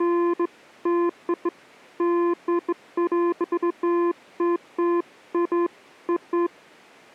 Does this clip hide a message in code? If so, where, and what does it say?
No, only beeps of irregular length.